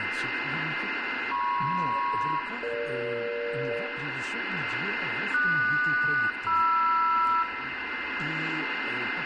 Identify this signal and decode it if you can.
Aircraft SELCAL, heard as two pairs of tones, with radio static, a steady whistle near 2080 Hz and room echo. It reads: MP-EG QS-MR